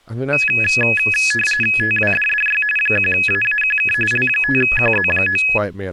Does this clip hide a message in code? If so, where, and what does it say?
Yes: RTTY (45.45 baud, 850 Hz shift) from 0.3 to 5.6 s, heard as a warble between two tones, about 2100 Hz centre, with speech in English. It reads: TWDDY 1AAQK L5QZ9